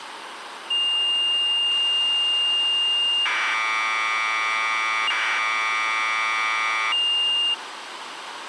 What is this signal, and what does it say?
Commodore tape loading (standard loader), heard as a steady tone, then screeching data, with tape hiss.